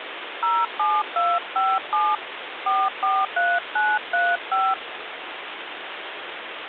DTMF, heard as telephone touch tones, dialled by hand, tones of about 220 ms, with phone line noise. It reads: 07257 443935